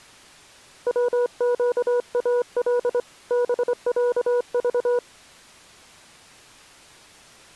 Morse code (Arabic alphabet), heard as a keyed tone, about 25 wpm, 490 Hz. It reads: وقال بعض